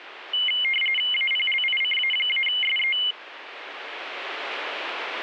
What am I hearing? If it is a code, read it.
RTTY (45.45 baud, 850 Hz shift), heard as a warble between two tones, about 2550 Hz centre. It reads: APLICA-SE